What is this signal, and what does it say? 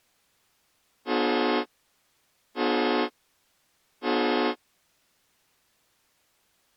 Train horn signal, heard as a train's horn. 3 short. On North American railways: when stopped, the train will back up.